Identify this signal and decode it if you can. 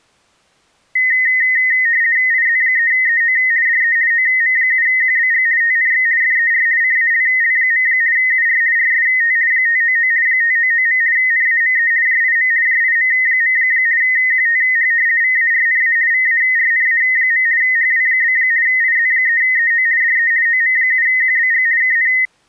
RTTY (50 baud, 170 Hz shift), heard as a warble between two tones, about 1950 Hz centre. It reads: IZ3EO DE OM7QBG TNX FER CALL. UR RST 599 599. NAME JIM JIM. QTH VARNA VARNA. HW? IZ3EO DE OM7QBG KN